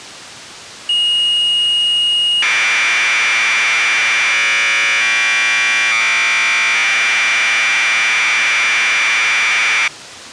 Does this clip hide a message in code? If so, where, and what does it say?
Yes: Commodore tape loading (standard loader) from 0.9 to 9.9 s, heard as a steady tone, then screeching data.